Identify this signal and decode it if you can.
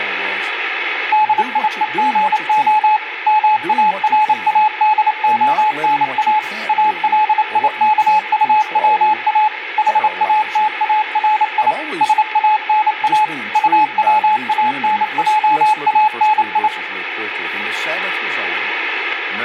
Morse code, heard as a keyed tone, machine-sent, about 28 wpm, 860 Hz, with radio static, room echo and speech in English. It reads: DIEGO MARADONA ALIKUWA HATARI SANA UWANJANI